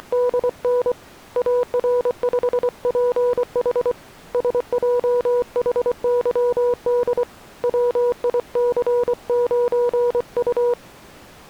Morse code, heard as a keyed tone, hand-sent with a paddle, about 24 wpm, 490 Hz. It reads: … AR5PH SJHYD WIC9U